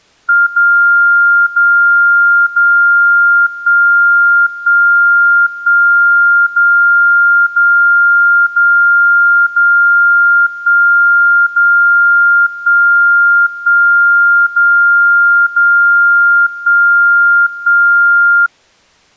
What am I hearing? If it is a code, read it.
Radio time signal (DCF77), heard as a tone whose level steps once a second, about 1400 Hz. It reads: 0 0 0 1 1 1 0 0 0 0 1 0 1 1 0 0 1 1